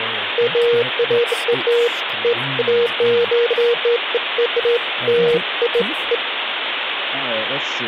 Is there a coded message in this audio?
No, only beeps of irregular length, with phone line noise and speech in English.